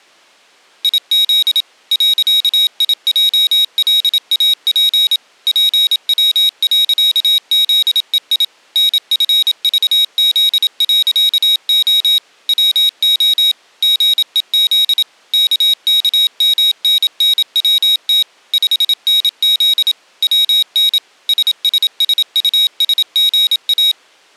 Morse code, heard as a high beeper, machine-sent, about 27 wpm, 3800 Hz. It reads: IZ .IJLAP PW.ZEI NFVZ.O WO GEZ KKMNNWT 5NZ WN SSSUSGA